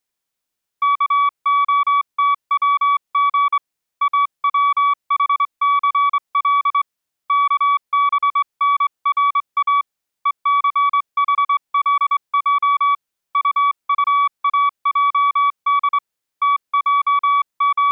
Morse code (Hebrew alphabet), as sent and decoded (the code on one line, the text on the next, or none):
-.- --- - .-- --. / .- .-- .... -.-. .-.. / -.- -... -. .-. .- / . -.-. .... .-.. .--- / ..- ..- .- .--- -.. / …
כהתצג אצחסל כבנרא וסחלע טטאעד …